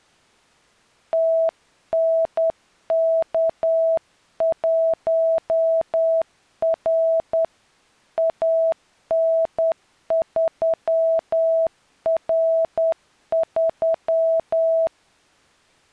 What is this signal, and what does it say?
Morse code, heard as a keyed tone, hand-sent with a straight key, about 10 wpm, 650 Hz. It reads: TNK1R AN3R3